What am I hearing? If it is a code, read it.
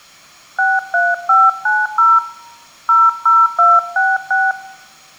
DTMF, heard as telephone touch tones, dialled by hand, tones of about 210 ms. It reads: 63590 00266